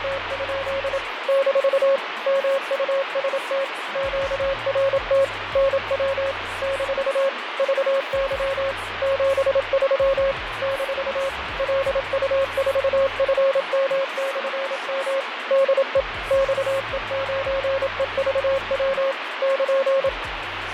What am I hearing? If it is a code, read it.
Morse code, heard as a keyed tone, machine-sent, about 27 wpm, 540 Hz, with radio static and fading. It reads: … - MUST QRT NW - VY 73 - LU4FM/M DE XE9EVW <KN>